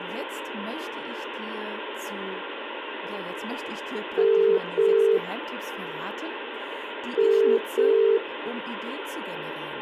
Telephone call progress tone (as in the UK, Ireland, Australia and similar networks), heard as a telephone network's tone, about 400, 450 Hz, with phone line noise and speech in German. Ringback tone.